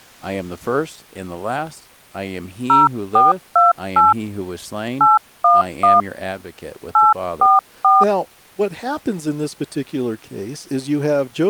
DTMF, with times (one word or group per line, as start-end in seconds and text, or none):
2.7-4.1 0428
5.0-6.0 811
6.9-8.0 844